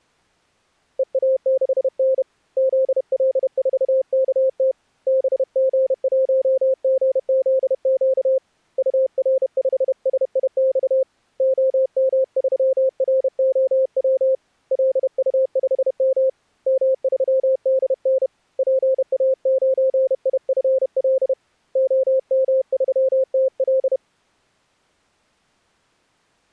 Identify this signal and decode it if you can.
Morse code, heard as a keyed tone, hand-sent with a bug key, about 31 wpm, 530 Hz. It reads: EA6N ZL4KT BG1GZQ UR5SIX OM3ROW LU5M M3DN PA9IFL OM3TL